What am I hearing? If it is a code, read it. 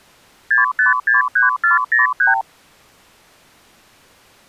Multi-frequency trunk signalling (R2, with the far end's replies), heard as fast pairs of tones, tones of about 140 ms. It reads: 6563403